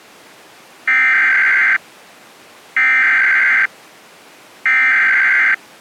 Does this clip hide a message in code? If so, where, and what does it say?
Yes: Emergency Alert System (SAME) tones (header bursts) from 0.9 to 5.5 s, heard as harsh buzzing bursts, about 520.83 baud.